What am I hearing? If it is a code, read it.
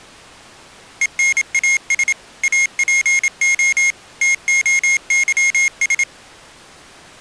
Morse code (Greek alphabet), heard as a high beeper, machine-sent, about 27 wpm, 2150 Hz. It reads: ΕΝΑΣ ΑΠΟ ΤΟΥΣ